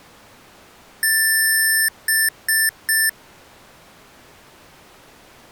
Beep code, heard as beeps from a small speaker, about 1750 Hz. 1 long, 3 short. In Award and IBM BIOS tables: video adapter failure; in AMI BIOS tables: memory failure.